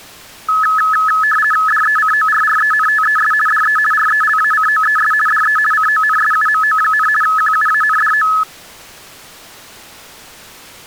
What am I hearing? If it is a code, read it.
RTTY (50 baud, 450 Hz shift), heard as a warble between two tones, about 1500 Hz centre. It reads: DECORRENTES DE RELACOES DE CONSUMO, QUANDO